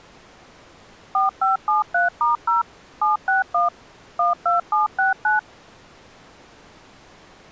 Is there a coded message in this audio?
Yes: DTMF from 1.1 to 5.4 s, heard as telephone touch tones, dialled by machine, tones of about 140 ms. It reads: 4573*0 761 12769